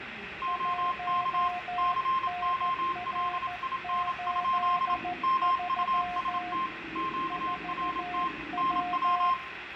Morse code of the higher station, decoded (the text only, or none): OK COLIN? MUST QRT NW